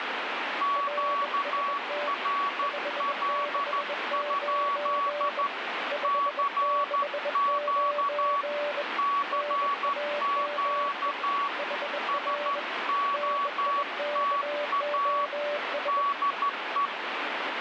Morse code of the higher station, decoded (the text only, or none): QRL? CQ CQ SOTA DE